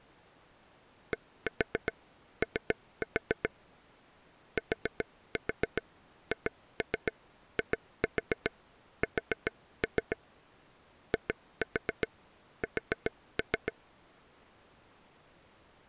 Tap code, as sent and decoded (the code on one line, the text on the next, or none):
1-4 3-4 / 4-4 2-3 2-4 4-3 / 2-4 4-3
DO THIS IS